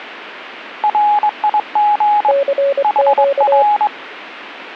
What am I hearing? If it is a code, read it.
Morse code, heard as two keyed tones. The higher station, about 22 wpm, 840 Hz: RIG HR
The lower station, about 24 wpm, 560 Hz: CQ